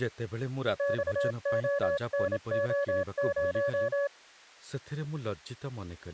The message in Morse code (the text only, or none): XONO0